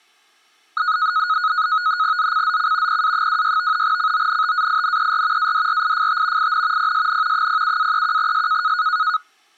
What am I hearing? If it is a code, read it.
NAVTEX (SITOR-B), 100 baud, 170 Hz shift, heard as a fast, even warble, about 1360 Hz centre. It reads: ZCZC PA26 CONTAINER ADRIFT IN PSN 07-31S